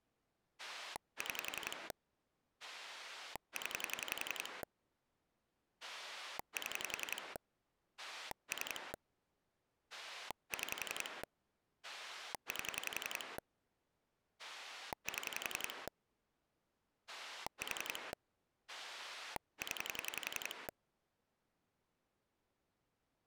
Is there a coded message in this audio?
Yes: pulse dialling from 0.6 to 20.7 s, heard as a rotary dial, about 11 pulses a second. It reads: 6 0 7 3 6 8 7 4 0